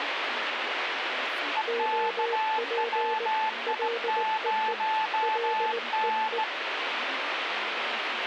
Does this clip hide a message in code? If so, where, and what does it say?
Yes: Morse code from 1.5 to 6.5 s, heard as two keyed tones, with radio static and speech in Malayalam. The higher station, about 17 wpm, 870 Hz: EKWI0N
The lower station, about 19 wpm, 470 Hz: OP LEE LEE